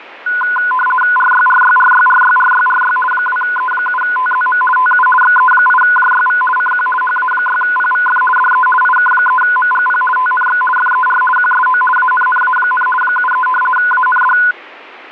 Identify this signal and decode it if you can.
RTTY (50 baud, 450 Hz shift), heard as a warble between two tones, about 1240 Hz centre. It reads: RYRYRYRYRYRY 2E7TZM TU XE8JYV CQ HA6PVF DE IK3MGP TNX FER QSO ANNA, 73 AND